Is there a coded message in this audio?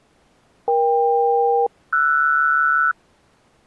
Yes: aircraft SELCAL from 0.7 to 2.9 s, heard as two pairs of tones. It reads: EK-RS